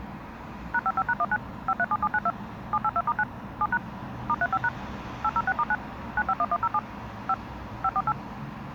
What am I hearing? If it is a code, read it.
DTMF, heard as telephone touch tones, dialled by machine, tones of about 50 ms, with the noise of a residential street. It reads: #55#19 537792 782*9 7# *35# 806*9 951107 5 548